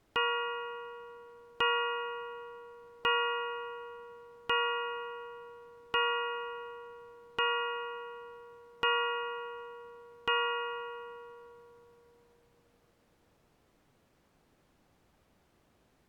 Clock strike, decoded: 8

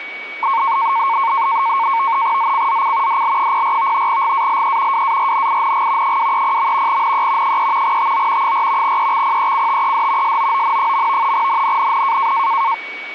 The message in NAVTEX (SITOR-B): ZCZC DL04 GALE WARNING 230. NE 3 TO 4 EXPECTED SOON. NNNN

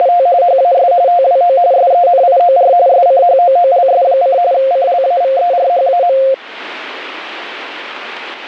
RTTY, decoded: … HAS TWO SENIOR SCHOOLS: CLAVERHAM

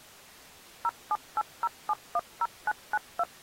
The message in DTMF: 0780710992

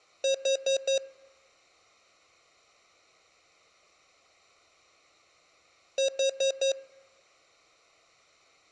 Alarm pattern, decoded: temporal four

